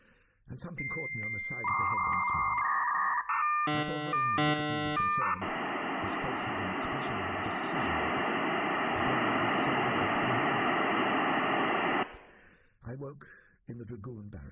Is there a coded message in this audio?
Yes: dial-up modem handshake (V.34 or later) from 0.8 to 12.0 s, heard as a whistle, warbles, then hiss.